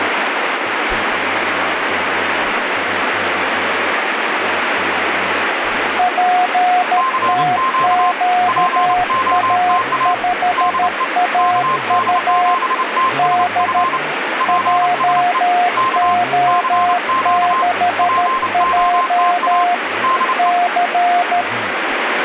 Morse code, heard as two keyed tones, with radio static and speech in English. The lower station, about 13 wpm, 720 Hz: PTQA5AU D JO6J C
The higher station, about 29 wpm, 1050 Hz: CQ POTA DE KD7TSF PSE K CQ POTA DE